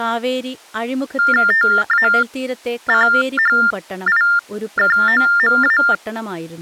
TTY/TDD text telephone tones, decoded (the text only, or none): TACHIKOMA